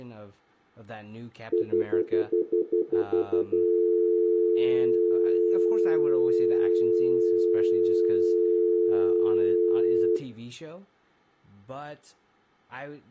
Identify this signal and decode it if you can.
Telephone call progress tone (North American plan), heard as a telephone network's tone, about 350, 440 Hz, 0.1 s on and 0.1 s off, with room echo and speech in English. Stutter dial tone.